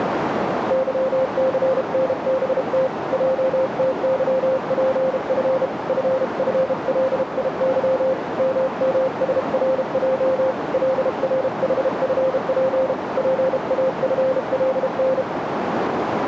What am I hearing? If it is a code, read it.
Morse code, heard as a keyed tone, hand-sent with a bug key, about 32 wpm, 520 Hz, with radio static and a narrow filter. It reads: YCNBT JTYPF FFLIY MMSRJ LRHFP PAFLN